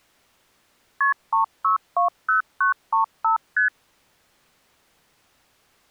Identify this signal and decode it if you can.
Multi-frequency trunk signalling (R1, as on North American trunks), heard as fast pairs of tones, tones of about 120 ms. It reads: KP 3620935 ST